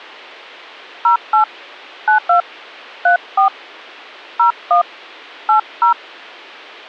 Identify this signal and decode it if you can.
DTMF, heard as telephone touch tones, dialled by hand, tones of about 110 ms. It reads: 08 92 34 01 80